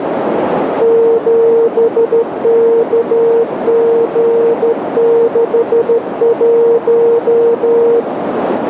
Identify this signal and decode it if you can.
Morse code, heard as a keyed tone, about 13 wpm, 460 Hz, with radio static and a narrow filter. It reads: 7KG61